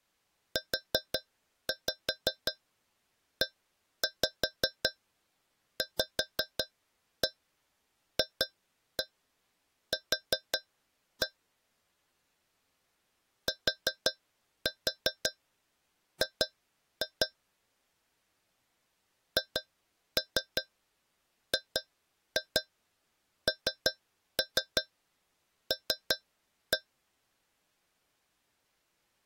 Tap code, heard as taps on a metal pipe, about 5 knocks a second. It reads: UEVFQ TG HGNL